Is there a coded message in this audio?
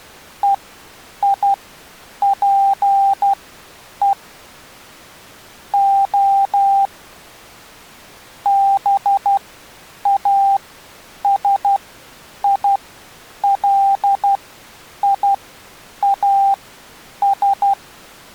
Yes: Morse code (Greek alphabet) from 0.4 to 17.8 s, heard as a keyed tone, machine-sent, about 12 wpm, spaced as for 8 wpm, 790 Hz. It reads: ΕΙΠΕ Ο ΒΑΣΙΛΙΑΣ